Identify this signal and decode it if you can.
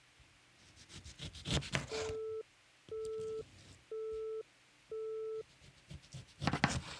Telephone call progress tone (single-tone plan, as in Europe, Japan and elsewhere), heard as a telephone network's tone, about 440 Hz, 0.5 s on and 0.5 s off, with kitchen noise. Busy tone.